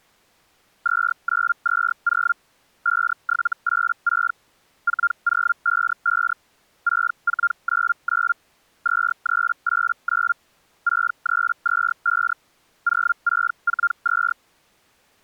Hellschreiber (Feld-Hell, 122.5 baud), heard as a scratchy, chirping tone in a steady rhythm, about 1400 Hz. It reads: 2920 5786 4055 6499 2389 6325 0642